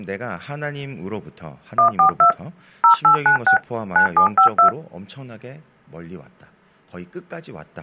DTMF, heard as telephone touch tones, dialled by machine, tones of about 100 ms, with speech in Korean. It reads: 142 0896 9752